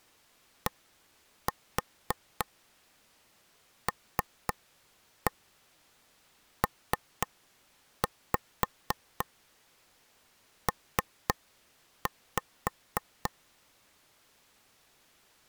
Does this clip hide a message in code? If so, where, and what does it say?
Yes: tap code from 0.7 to 13.3 s, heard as taps on a table, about 3 knocks a second. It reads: DLPP